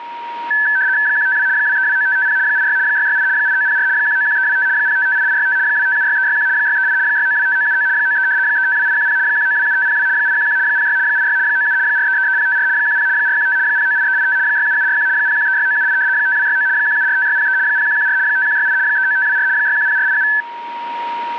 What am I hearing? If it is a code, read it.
RTTY (75 baud, 170 Hz shift), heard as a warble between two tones, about 1650 Hz centre, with a steady whistle near 940 Hz. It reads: 152 2329550 86 668 8904 191325 0558865 2576361 638 6925979 93 352810 1927502 811 06 86 97 4333054 10 415 098385 67741 0136978 5269 1745603 0114 5168 39524 610487